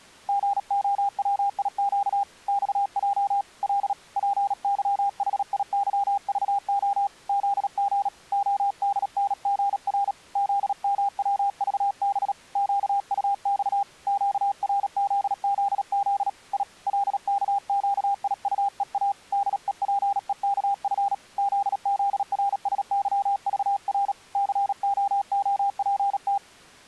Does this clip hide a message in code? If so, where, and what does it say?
Yes: Morse code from 0.2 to 26.4 s, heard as a keyed tone, hand-sent with a paddle, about 37 wpm, 800 Hz. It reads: GOWIQ XJ L PYHIYVO ZG ODNGR ZMWVB QUX QRZZZ I LKQIUEA DEPEKF ZZRSYVR COOPT